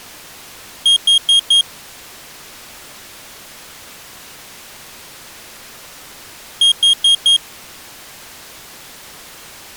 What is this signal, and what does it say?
Alarm pattern, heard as an alarm's beeps, played twice, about 3250 Hz. Temporal four. Carbon monoxide.